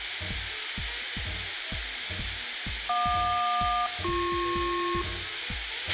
Aircraft SELCAL, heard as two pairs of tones, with radio hiss and a squelch burst at the end. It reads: JQ-BP